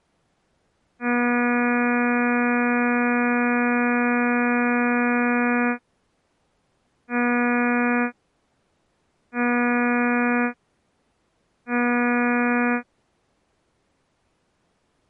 Ship horn signal, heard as a ship's horn, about 240 Hz. 1 long, 3 short. At sea: a vessel under tow in fog.